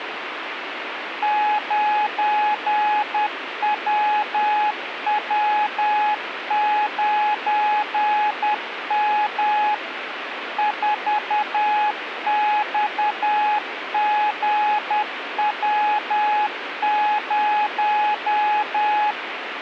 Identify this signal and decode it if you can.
Morse code, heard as a keyed tone, machine-sent, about 10 wpm, 840 Hz, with radio static. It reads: 9WW9M 4XGW0